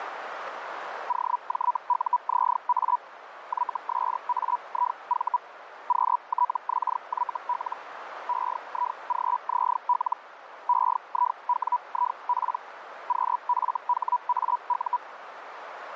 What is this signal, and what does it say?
Hellschreiber (Feld-Hell, 122.5 baud), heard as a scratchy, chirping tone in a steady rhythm, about 980 Hz, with radio static and a narrow filter. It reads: OJUZA YSAIV QTXYL EIGZL EIWIP QFHAU